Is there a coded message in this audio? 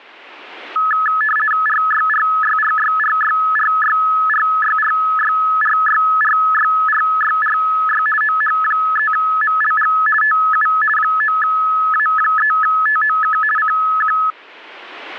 Yes: RTTY (50 baud, 450 Hz shift) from 0.8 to 14.3 s, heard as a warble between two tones, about 1500 Hz centre. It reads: RYRYRYRYRYRYRYRYRYRYRY OH3MLG TU 9A3TOK CQ